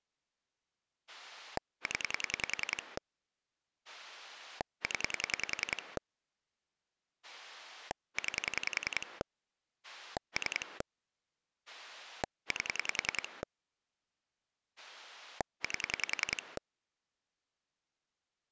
Pulse dialling, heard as a rotary dial, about 10 pulses a second. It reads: 0 0 9 3 8 8